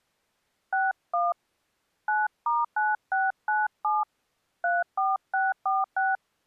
DTMF, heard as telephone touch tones, dialled by hand, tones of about 190 ms. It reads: 61 9*9697 34646